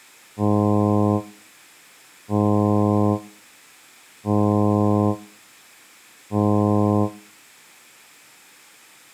Ship horn signal, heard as a ship's horn, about 100 Hz. 4 short. At sea: a pilot vessel's identity signal in fog.